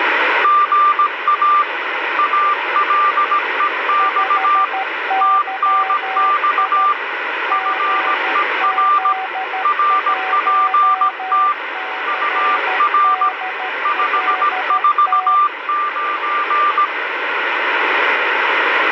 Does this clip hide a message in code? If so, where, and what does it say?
Yes: Morse code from 0.4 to 16.9 s, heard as two keyed tones, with radio static. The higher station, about 17 wpm, 1190 Hz: GA ALEX TNX FER RPT UR 549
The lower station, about 13 wpm, 760 Hz: 5YI GZ1CDLT